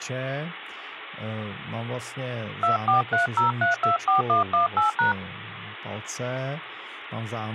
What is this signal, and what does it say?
DTMF, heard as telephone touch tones, dialled by hand, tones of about 130 ms, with speech in Czech. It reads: 2430324118#